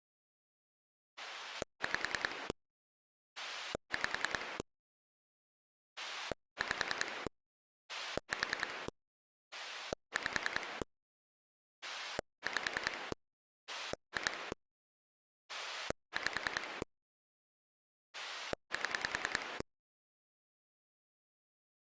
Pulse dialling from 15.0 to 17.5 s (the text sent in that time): 5